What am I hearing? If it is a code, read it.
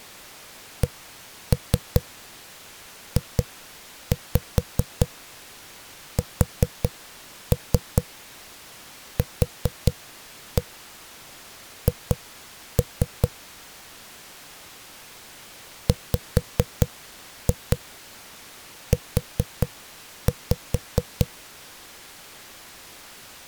Tap code, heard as knocks on a wall, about 4 knocks a second. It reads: CJSQH WU